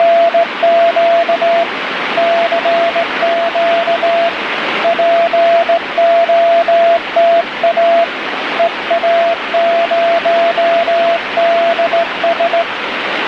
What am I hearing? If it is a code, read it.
Morse code, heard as a keyed tone, hand-sent with a straight key, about 17 wpm, 680 Hz, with radio static. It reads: … CQ POTA EA0DS